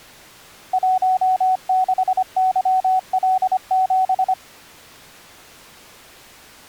Morse code, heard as a keyed tone, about 25 wpm, 750 Hz. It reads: 16YL7